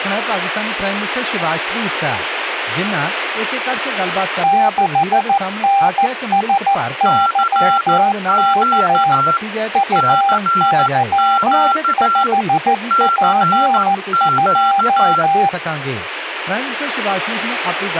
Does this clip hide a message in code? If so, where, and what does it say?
Yes: Morse code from 4.4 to 15.6 s, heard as two keyed tones, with radio static. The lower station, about 14 wpm, 790 Hz: 6NSYK UY5P2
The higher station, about 14 wpm, 1360 Hz: CQ CQ CQ